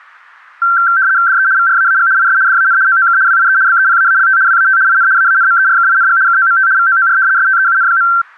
RTTY (75 baud, 170 Hz shift), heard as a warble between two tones, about 1460 Hz centre. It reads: DE VRAAG IS DAN OOK WIE BEPAALT WAT IN AANMERKING KOMT VOOR STEUN.